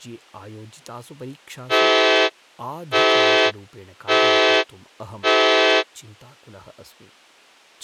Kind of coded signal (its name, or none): train horn signal